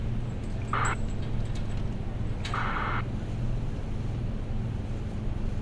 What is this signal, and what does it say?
ACARS aircraft data, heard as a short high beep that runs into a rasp, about 2400 baud, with street noise.